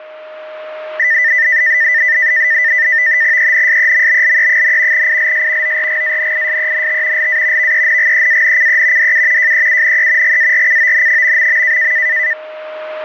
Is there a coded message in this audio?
Yes: NAVTEX (SITOR-B), 100 baud, 170 Hz shift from 1.0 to 12.3 s, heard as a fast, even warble, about 1900 Hz centre, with a steady whistle near 620 Hz. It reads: ENSEMBLE, ILS ORGANISENT LA VENGEANCE DU JEUNE GARCON...